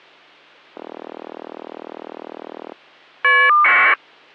Caller ID data burst, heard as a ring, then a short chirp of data, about 1200 baud.